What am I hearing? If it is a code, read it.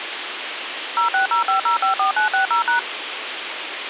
DTMF, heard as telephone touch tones, dialled by machine, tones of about 120 ms, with radio hiss. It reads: 0605054960#